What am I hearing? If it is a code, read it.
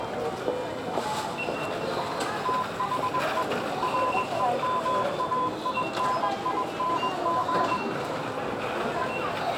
Morse code, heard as a keyed tone, machine-sent, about 21 wpm, 1010 Hz, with the noise of a crowd indoors. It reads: THE REMAINING